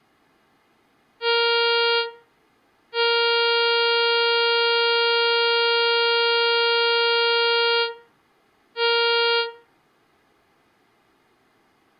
Ship horn signal, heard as a ship's horn, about 470 Hz, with room echo. 1 short, 1 long, 1 short. At sea: a vessel at anchor warns of its position.